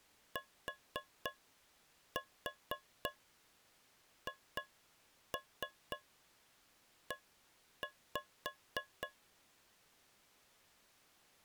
Tap code, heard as taps on a metal pipe, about 3 knocks a second. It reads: THE